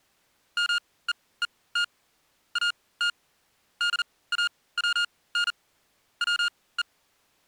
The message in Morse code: MEET AT DAWN WE

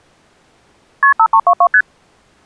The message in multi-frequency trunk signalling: KP 5322 ST

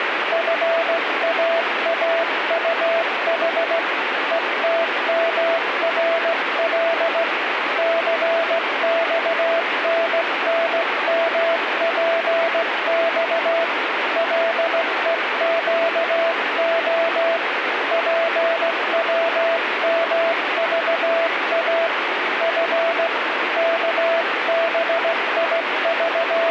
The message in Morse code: FAAUH ETMRL CXNNMPX LEQO PWMVA F …

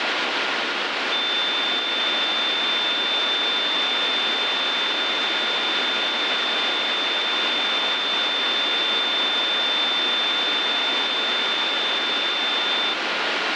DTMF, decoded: none

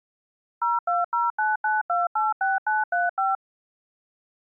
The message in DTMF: 02099286935

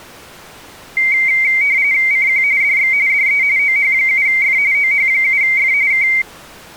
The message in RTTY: CQ DX DE OH7F OH7F K

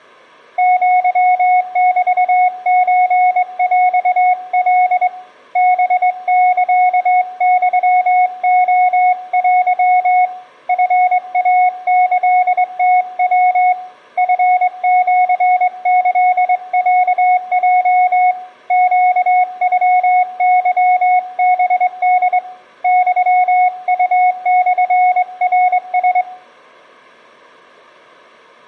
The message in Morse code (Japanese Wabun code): アメソヰカ ハサユレテ チイキムヤ チシキロヲ ネノケハホ ユウモナラ

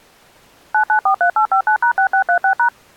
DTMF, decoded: 9943859#6636#

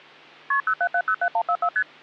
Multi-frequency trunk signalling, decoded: KP 07707144 ST

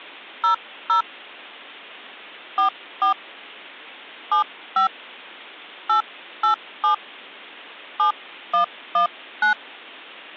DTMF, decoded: 00 44 75 887 7119

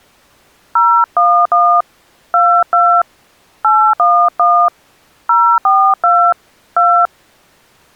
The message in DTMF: 011 22 811 042 2

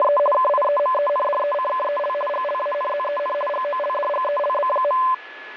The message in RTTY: … KIEMENDECKEL GLANZEN GOLDGELB.

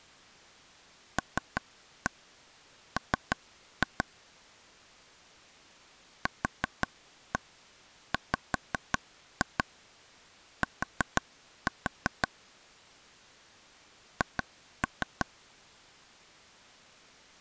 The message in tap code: LM QWT H

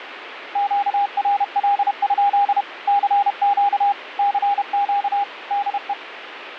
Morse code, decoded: QRL? CQ CQ DE

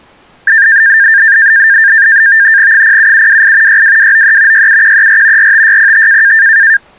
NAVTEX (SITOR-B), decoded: 07728 62293 67134 45605

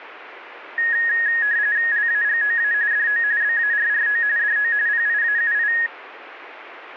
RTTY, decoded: LAGOA DO BARRO DO PIAUI

